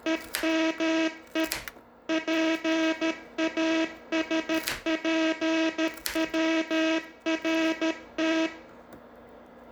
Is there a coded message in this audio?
Yes: Morse code (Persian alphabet) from 0.0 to 8.5 s, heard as a buzzer, machine-sent, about 13 wpm, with room echo and kitchen noise. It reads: همه پاسپورت